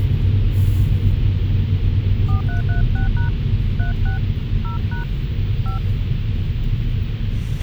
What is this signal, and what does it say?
DTMF, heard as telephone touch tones, dialled by hand, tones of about 120 ms, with radio hiss, a squelch burst at the end and the noise inside a car. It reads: 4336# 36 0# 5